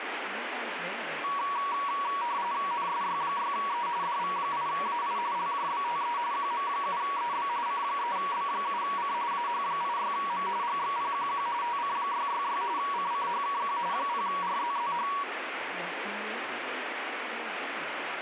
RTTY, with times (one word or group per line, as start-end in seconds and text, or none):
2.7-3.9 NSY6E
4.0-5.2 DV8AI
5.3-6.2 LJBTE
6.3-7.5 QM7EB
7.7-9.1 C3B7C
9.3-10.5 AH86M
10.6-11.5 GXPQQ
11.6-12.6 TC666
12.8-13.8 CCHKQ
13.9-15.1 0RZZH